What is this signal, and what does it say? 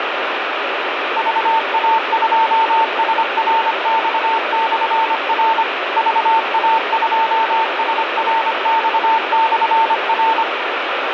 Morse code, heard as a keyed tone, machine-sent, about 25 wpm, 900 Hz, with heavy radio static. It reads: VA2SRX/R VA2SRX/R